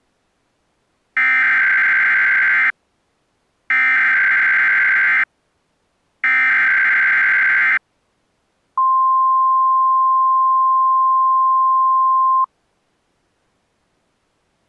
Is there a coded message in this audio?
Yes: Emergency Alert System (SAME) tones (header bursts, then the 1050 Hz attention tone) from 1.2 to 12.4 s, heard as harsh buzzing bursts, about 520.83 baud.